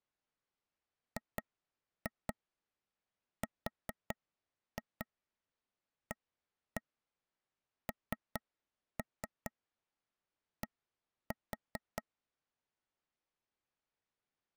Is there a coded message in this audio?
Yes: tap code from 1.2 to 12.0 s, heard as taps on a table, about 4 knocks a second. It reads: GRAND